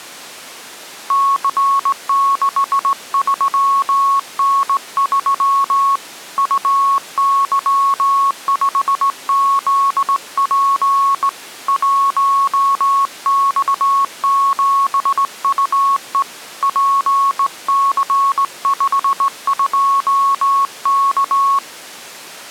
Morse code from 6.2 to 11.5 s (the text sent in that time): UY5ZP